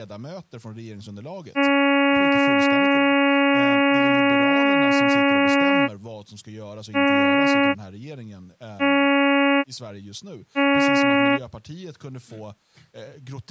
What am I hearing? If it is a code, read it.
Ship horn signal, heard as a ship's horn, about 280 Hz, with speech in Swedish. 1 long, 3 short. At sea: a vessel under tow in fog.